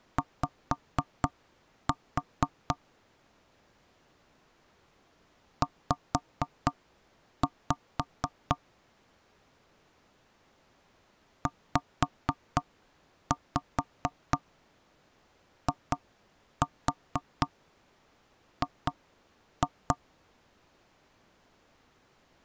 Tap code, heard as knocks on wood, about 4 knocks a second. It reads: Y Z ZIG